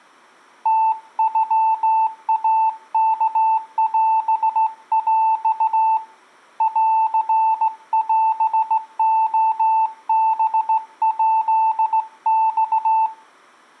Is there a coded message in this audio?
Yes: Morse code (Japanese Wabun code) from 0.6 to 13.1 s, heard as a keyed tone, hand-sent with a straight key, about 16 wpm, 890 Hz. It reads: ムノイワオヰ ンオレハヱマ